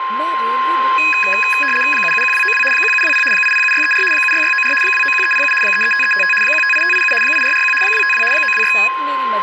RTTY (75 baud, 850 Hz shift), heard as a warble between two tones, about 2100 Hz centre, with radio static, a steady whistle near 1050 Hz and speech in Hindi. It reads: 771292 1720 807634 76694 291307 335355 158587 8441 252 926